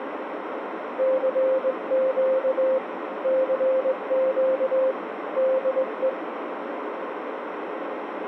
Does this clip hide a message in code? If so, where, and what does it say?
Yes: Morse code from 0.9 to 6.2 s, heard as a keyed tone, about 20 wpm, 520 Hz, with radio static and a narrow filter. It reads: CQ CQ DE